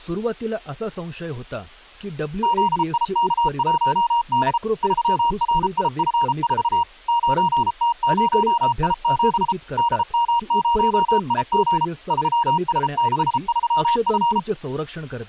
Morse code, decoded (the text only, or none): ZIK1D 3RIF4 9T0I7 DM0IG 3S63F